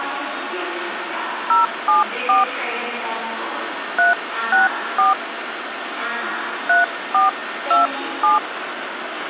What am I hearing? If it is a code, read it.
DTMF, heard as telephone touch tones, dialled by hand, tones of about 150 ms, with the noise of a subway station. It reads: 074 364 3427